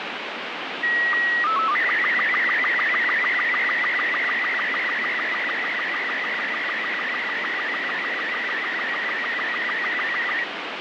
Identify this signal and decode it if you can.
SSTV (slow-scan television), Robot 36, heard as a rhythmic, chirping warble, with heavy radio static.